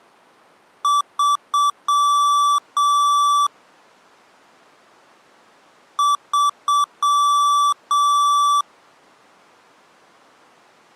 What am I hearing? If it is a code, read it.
Beep code, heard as beeps from a small speaker, played twice, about 1160 Hz. 3 short, 2 long.